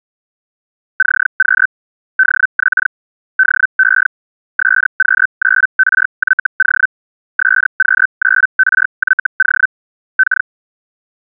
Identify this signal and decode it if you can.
Hellschreiber (Feld-Hell, 122.5 baud), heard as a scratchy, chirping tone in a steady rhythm, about 1550 Hz. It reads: CQ DX DE SQ9RYO SQ9RYO K